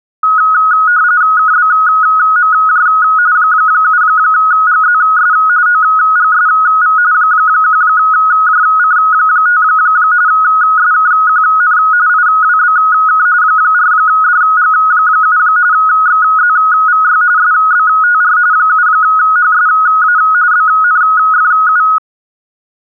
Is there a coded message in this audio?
Yes: RTTY (45.45 baud, 170 Hz shift) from 0.2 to 22.0 s, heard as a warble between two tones, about 1360 Hz centre. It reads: KBMJ 7GZS OGSV 1JC5 SKQN IWBK 4DG7 XZVY SBTR 7HSA BNFU